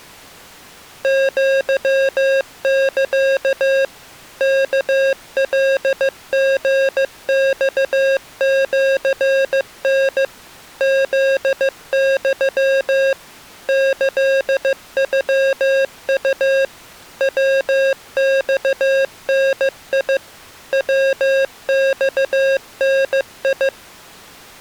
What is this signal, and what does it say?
Morse code (Japanese Wabun code), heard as electronic beeps, machine-sent, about 15 wpm, 540 Hz. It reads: アサ ワカリマシタ フユ キノウ ヤマダ ヤマダ